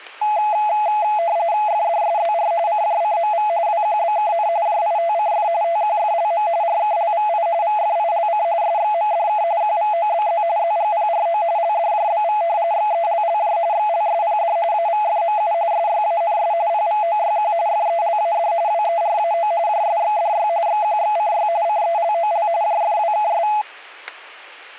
RTTY (45.45 baud, 170 Hz shift), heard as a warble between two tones, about 760 Hz centre, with static crashes. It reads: FDSZR CJCMV WQBKN JITCF TQFLM RKLVI VFILC SXMDK QVOBZ ZGPRO LDJBV XELLJ XLSPD AVFMU SYANS PVOYQ FELAD WERAO JSXDY XQXCY CELOL JFWKS